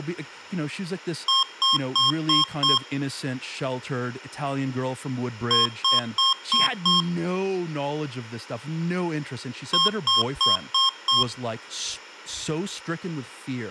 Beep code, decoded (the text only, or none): 5 short